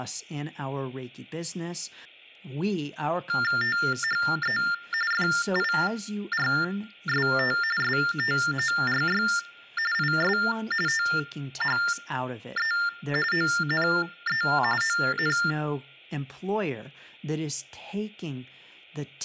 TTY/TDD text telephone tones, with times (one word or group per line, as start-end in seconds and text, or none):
3.6-4.6 THE
5.1-7.6 FIRST
7.8-9.2 STORY
9.9-10.4 IS
10.9-12.7 THE
13.3-14.4 ONE
14.8-15.4 ON